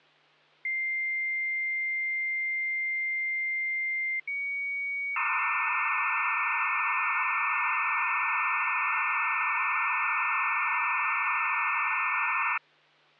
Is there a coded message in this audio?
Yes: dial-up modem handshake (low-speed, two carriers) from 0.6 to 12.6 s, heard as two whistles, then hiss, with hum.